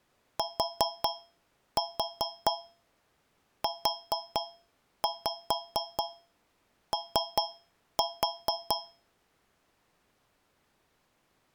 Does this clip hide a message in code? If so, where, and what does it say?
Yes: tap code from 0.4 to 9.1 s, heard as taps on a metal pipe, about 4 knocks a second. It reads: TUO